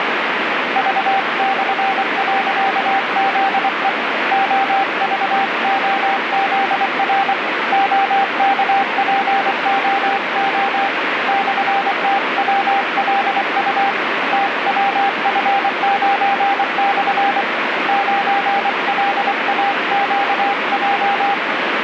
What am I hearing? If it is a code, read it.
Morse code, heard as a keyed tone, hand-sent with a paddle, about 24 wpm, 790 Hz, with heavy radio static. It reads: V/.ZE OVOZR OKPOO /TWLU TWF9/ 9LAQJ